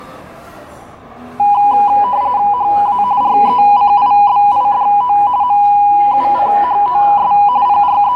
RTTY (45.45 baud, 170 Hz shift), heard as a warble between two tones, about 900 Hz centre, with the noise of a restaurant. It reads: HA RECIBIDO MUCHOS …